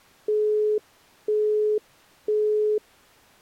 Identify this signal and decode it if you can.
Telephone call progress tone (single-tone plan, as in Europe, Japan and elsewhere), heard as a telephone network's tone, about 420 Hz, 0.5 s on and 0.5 s off. Busy tone.